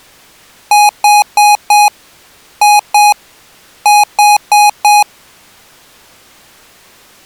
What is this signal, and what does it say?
Beep code, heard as beeps from a small speaker, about 830 Hz. 4-2-4. In Phoenix BIOS tables: unexpected interrupt in protected mode.